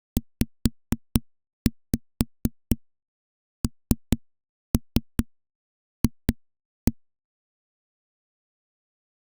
Tap code, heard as knocks on a wall, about 4 knocks a second. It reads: ZNF